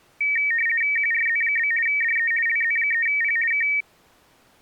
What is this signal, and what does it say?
RTTY (50 baud, 450 Hz shift), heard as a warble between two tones, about 2050 Hz centre. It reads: QRZ? DE LZ3P K